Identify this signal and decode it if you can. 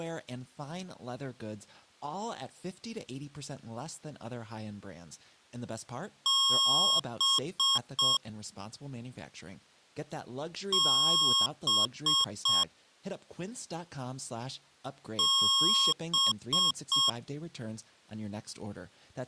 Beep code, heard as beeps from a small speaker, played three times, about 1090 Hz, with speech in English. 1 long, 3 short. In Award and IBM BIOS tables: video adapter failure; in AMI BIOS tables: memory failure.